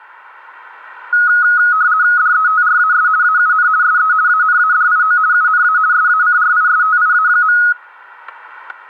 RTTY (50 baud, 170 Hz shift), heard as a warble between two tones, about 1360 Hz centre, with static crashes. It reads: DETRAS AUN SE ANADIO UNA SACRISTIA.